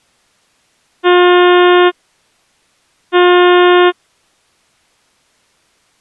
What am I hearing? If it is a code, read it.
Ship horn signal, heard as a ship's horn, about 360 Hz. 2 short. At sea: I am altering course to port.